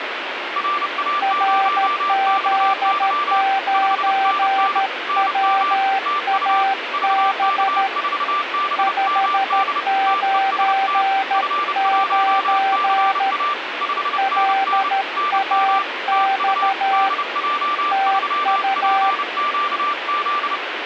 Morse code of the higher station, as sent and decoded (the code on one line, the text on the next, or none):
.-. .- ----- -..- -.-- / ..... -. -. / -. -- / - ..- / ...- -.- ....- -... -- -.. / - . ... - / ..-. .---- -.-. .- / ..... -. -. / -. -- / - ..- / -.. .--- ...-- .--. --.- --..
RA0XY 5NN NM TU VK4BMD TEST F1CA 5NN NM TU DJ3PQZ